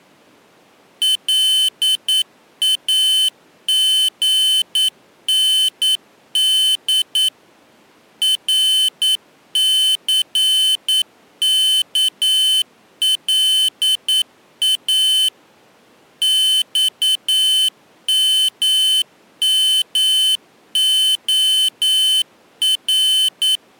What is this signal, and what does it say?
Morse code, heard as a high beeper, machine-sent, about 9 wpm, 3050 Hz. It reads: LAGND RCKLA XMMOR